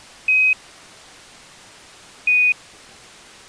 Quindar tones, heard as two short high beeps.